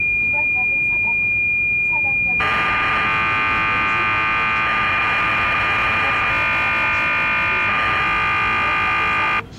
Cassette data (Kansas City type), 1200 baud, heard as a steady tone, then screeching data, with the noise inside a subway train.